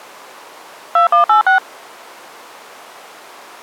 DTMF, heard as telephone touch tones, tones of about 120 ms. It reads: 2186